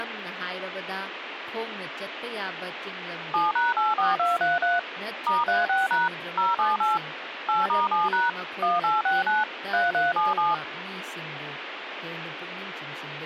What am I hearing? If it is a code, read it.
DTMF, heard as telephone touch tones, dialled by machine, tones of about 170 ms, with radio hiss and speech in Manipuri. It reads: 7#84233 *36# 078 8*7# 1869 3377